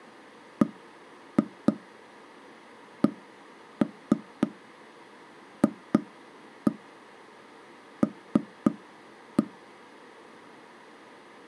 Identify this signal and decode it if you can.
Tap code, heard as knocks on wood, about 3 knocks a second. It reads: BCFL